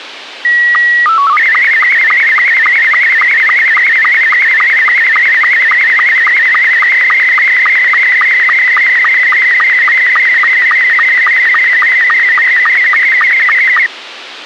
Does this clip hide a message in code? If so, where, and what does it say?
Yes: SSTV (slow-scan television), Scottie S2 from 0.4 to 13.9 s, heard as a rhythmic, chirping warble, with radio hiss.